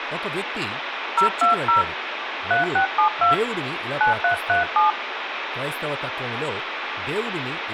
DTMF, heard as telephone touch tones, dialled by hand, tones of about 130 ms, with phone line noise, room echo and speech in Telugu. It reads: 020 3672 9337